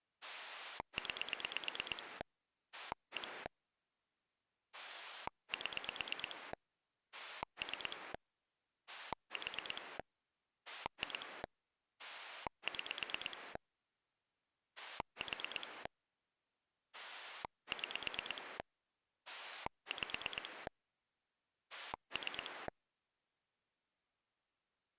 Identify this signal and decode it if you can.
Pulse dialling, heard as a rotary dial, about 8 pulses a second. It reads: 9 1 7 3 4 2 6 4 6 5 3